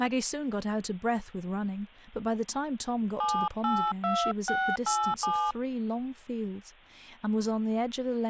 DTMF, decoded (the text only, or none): 782687